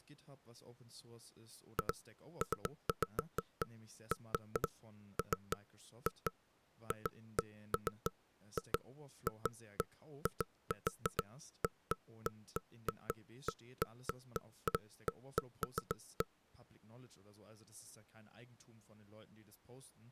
Irregular knocks on wood, with speech in German. There is no code.